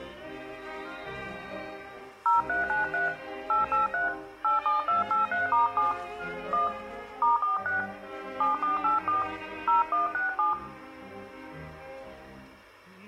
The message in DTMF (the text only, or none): 0393 883 87283*7 1 *46 7484 0167